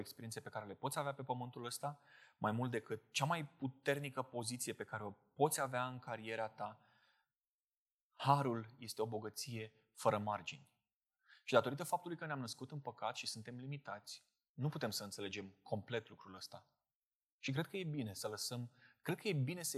Speech in Romanian. There is no code.